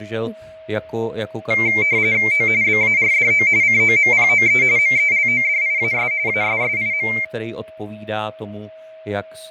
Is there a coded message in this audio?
Yes: RTTY (45.45 baud, 170 Hz shift) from 1.5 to 7.2 s, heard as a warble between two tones, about 2200 Hz centre, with fading, a steady whistle near 640 Hz and speech in Czech. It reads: O BARDO COMPOE MELODIAS ASSIM